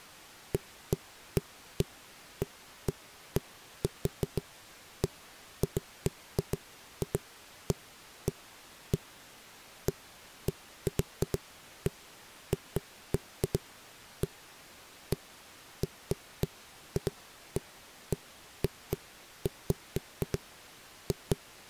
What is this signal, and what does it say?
Irregular knocks on a wall. There is no code.